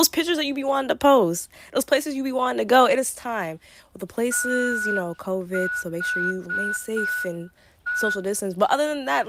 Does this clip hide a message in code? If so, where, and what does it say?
Yes: Morse code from 4.3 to 8.2 s, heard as a whistle, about 5 wpm, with room echo and speech in English. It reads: THE